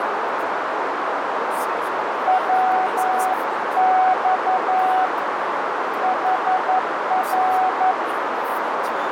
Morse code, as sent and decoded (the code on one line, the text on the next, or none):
.-- -..- / .... .-.
WX HR